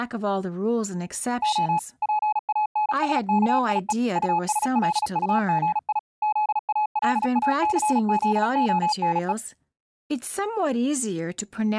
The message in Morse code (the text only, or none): O PANSKIE USLUGI ZALACZONE